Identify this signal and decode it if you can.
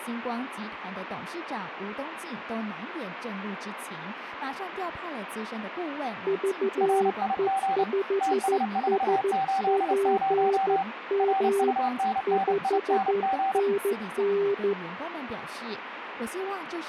Morse code, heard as two keyed tones, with radio static and speech in Chinese. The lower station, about 13 wpm, 400 Hz: VE5SPM 5NN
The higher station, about 29 wpm, 780 Hz: RIG TS480 RUNNING